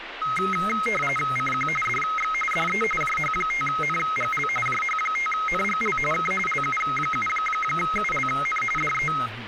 RTTY (45.45 baud, 850 Hz shift), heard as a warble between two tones, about 1700 Hz centre, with radio static and speech in Marathi. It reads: CQ DX DE JH5NGL JH5NGL K LU7ULN DE